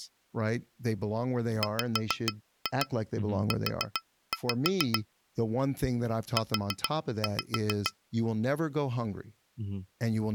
Tap code, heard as taps on glass, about 7 knocks a second, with speech in English. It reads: WU U